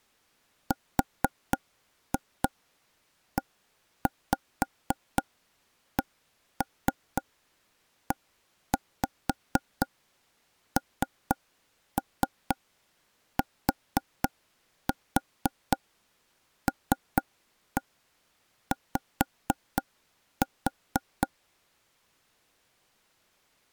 Tap code, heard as taps on a table, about 4 knocks a second. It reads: RECENTLY